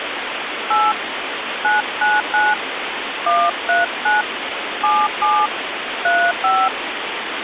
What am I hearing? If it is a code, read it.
DTMF, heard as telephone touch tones, dialled by hand, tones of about 220 ms, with phone line noise. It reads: 8 999 139 77 35